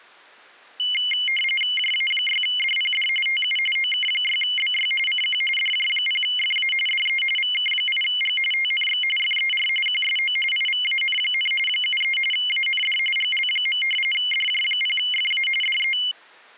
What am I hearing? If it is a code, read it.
RTTY (45.45 baud, 850 Hz shift), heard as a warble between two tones, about 2550 Hz centre. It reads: JA6DPD TU OK6BY CQ DJ0FA DE VK8G TNX FER QSO IVAN, 73 AND GL. DJ0FA DE